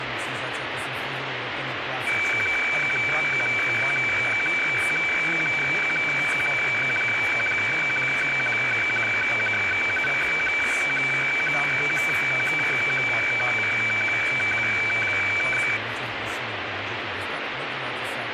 Weather fax (radiofax), 120 lines a minute, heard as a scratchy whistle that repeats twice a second, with radio static.